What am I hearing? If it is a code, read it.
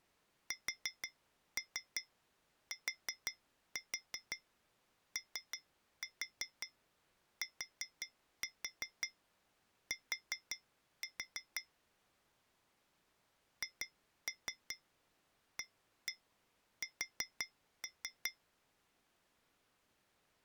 Tap code, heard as taps on glass, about 5 knocks a second. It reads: STOTT HAS